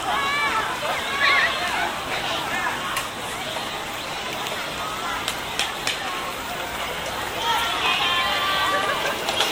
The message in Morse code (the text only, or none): none